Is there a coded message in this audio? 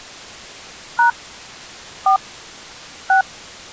Yes: DTMF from 1.0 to 3.2 s, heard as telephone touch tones, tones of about 110 ms. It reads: # 4 6